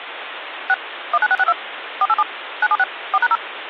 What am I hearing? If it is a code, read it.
DTMF, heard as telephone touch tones, dialled by machine, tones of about 40 ms, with phone line noise. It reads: 6 19662 487 976 4#0